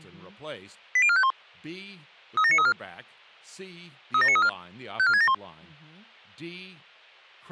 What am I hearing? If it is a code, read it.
Five-tone selective call (ZVEI), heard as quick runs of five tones, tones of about 70 ms, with speech in English. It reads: 80451 37934 37934 54671